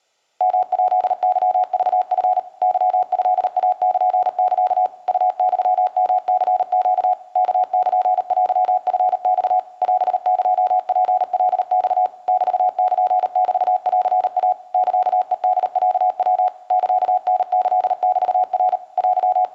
Morse code (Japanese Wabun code), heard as a keyed tone, machine-sent, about 38 wpm, 740 Hz, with room echo. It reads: ヨヱケクチ ケトイルサ ウユヨニネ ワルテチマ オエツカマ メルメンイ サヘホロヤ サタキメナ …